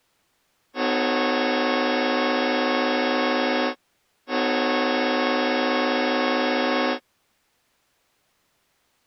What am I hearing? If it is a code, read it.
Train horn signal, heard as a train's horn. 2 long. On North American railways: brakes released, proceed.